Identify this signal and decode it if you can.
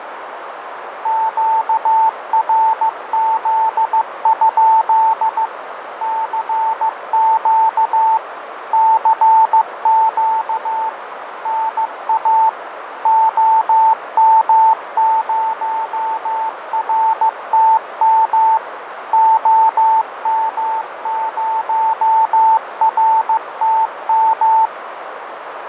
Morse code, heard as a keyed tone, machine-sent, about 15 wpm, 890 Hz, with radio static, fading and a narrow filter. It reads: QRZ? CQ CQ NA OM0RTM OM0RTM